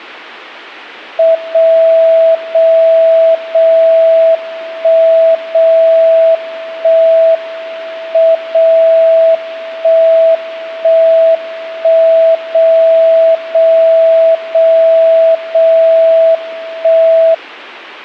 Radio time signal (WWVB), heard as a tone whose level steps once a second, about 660 Hz. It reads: 0 0 0 1 0 1 M 0 1 1 1 0 0 0 0 1